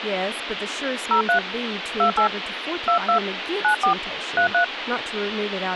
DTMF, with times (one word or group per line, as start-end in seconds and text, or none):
1.1-1.4 03
2.0-2.3 28
2.9-3.2 22
3.6-3.9 94
4.4-4.6 33